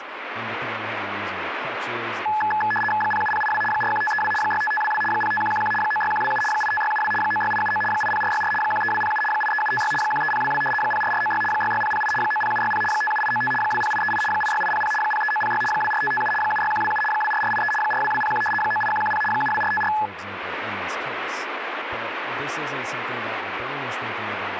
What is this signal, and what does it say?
RTTY (75 baud, 850 Hz shift), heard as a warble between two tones, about 1280 Hz centre, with radio static and speech in English. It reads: 07082 41532 65522 05111 96127 85672 96879 80464 13207 83756 13022 04496 66008 90760 57895 20838 86800 03906 24557 76127 24483 42201 98110 72454